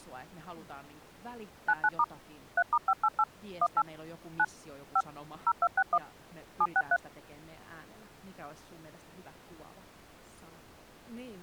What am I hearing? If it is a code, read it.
DTMF, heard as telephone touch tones, dialled by machine, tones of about 50 ms, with speech in Finnish. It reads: 99* 3*588 18 9 5 0261 763